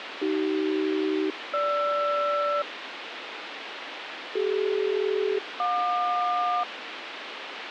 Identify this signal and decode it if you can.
Aircraft SELCAL, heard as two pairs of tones, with radio hiss. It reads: AC-GR CD-JQ